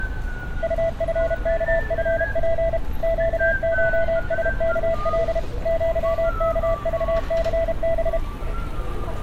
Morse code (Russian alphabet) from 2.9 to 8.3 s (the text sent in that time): ЩШСКЛ ЪКЖЦБ